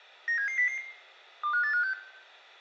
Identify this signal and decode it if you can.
Five-tone selective call (CCIR), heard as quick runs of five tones, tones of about 100 ms, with room echo. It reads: 97700 25856